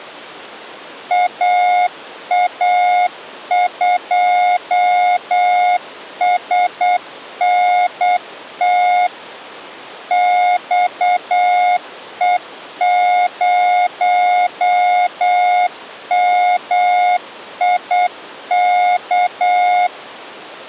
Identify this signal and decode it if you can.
Morse code, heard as a keyed tone, machine-sent, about 8 wpm, 720 Hz. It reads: AA2SNT XE0MIK